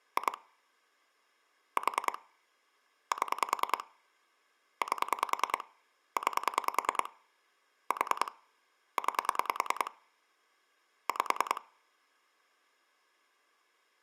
Pulse dialling, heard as clicks on a phone line, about 10 pulses a second. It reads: 2 4 7 8 9 4 9 5